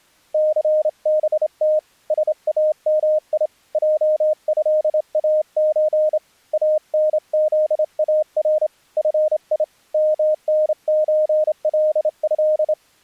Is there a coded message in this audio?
Yes: Morse code (Arabic alphabet) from 0.3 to 12.8 s, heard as a keyed tone, hand-sent with a straight key, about 28 wpm, 620 Hz. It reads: ثبت سامي جهاز انذار في منزله